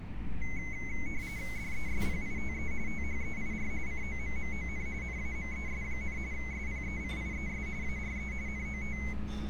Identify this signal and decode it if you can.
RTTY (45.45 baud, 170 Hz shift), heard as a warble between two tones, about 2150 Hz centre, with radio static and street noise. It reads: DESPITE THEIR COMMON NAMES, SPECIES ARE NOT